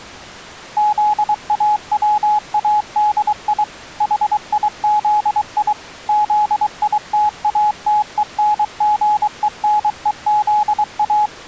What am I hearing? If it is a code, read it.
Morse code, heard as a keyed tone, machine-sent, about 23 wpm, 840 Hz. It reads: ZAWADI HIZI ZITATENGENEZA